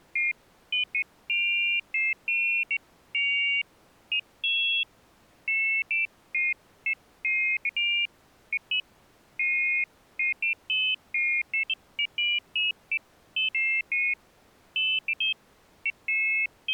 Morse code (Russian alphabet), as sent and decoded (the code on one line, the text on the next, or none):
none